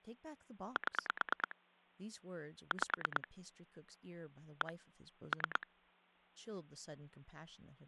Pulse dialling, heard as clicks on a phone line, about 9 pulses a second, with speech in English. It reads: 7 5 1 3